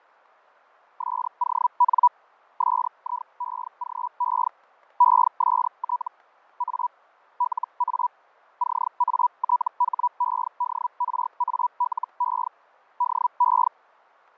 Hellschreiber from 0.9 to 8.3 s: SON SIEGE EST A LA

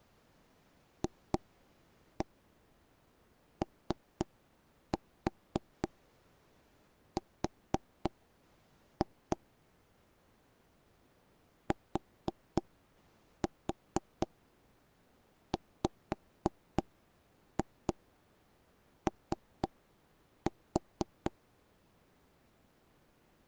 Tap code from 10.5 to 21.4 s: TWO

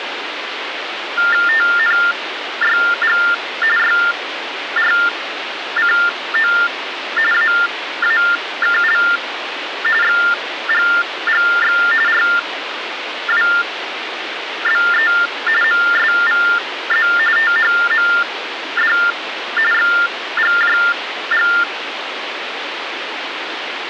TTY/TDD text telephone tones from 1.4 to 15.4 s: TNYG YRCO AAKL XGGX RWBE

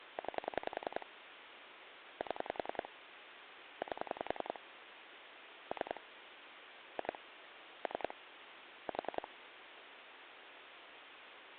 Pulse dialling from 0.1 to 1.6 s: 9

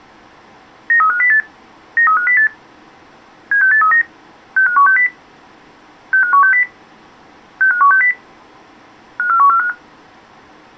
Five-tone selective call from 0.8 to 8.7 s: 93508 93508 76839 65160 65160 65160

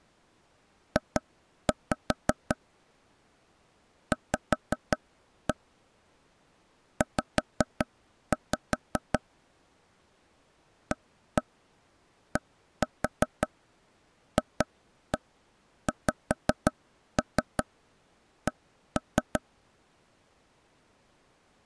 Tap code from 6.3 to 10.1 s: Z

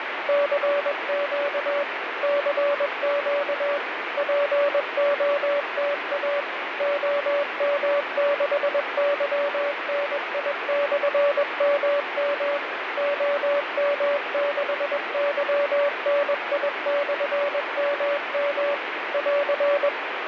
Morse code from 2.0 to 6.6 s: CQ POTA

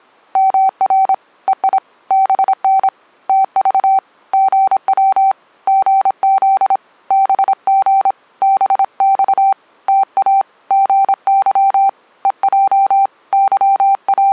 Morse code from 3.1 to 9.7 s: TV GW GZ BG BX

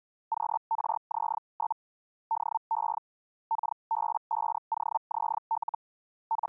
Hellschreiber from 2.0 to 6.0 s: DE KB5OZL

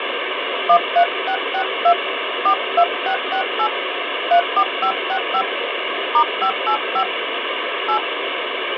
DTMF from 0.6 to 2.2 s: 13662

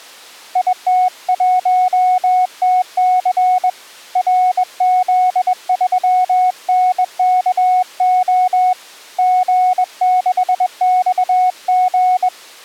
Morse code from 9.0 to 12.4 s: G6XG

